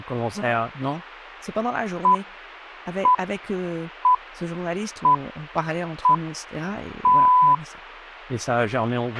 Radio time signal (six pips, as the Greenwich Time Signal), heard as pips, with a squelch burst at the end and speech in French.